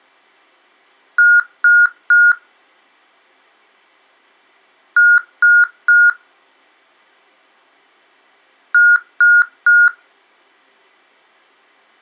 Beep code, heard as beeps from a small speaker, played three times, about 1430 Hz. 3 short. In AMI BIOS tables: failure in the first 64 KB of memory; in Dell tables: chipset error.